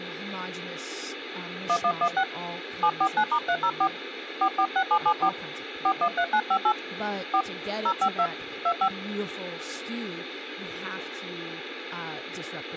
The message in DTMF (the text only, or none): 1116 749*304 446774 413958 4 052 25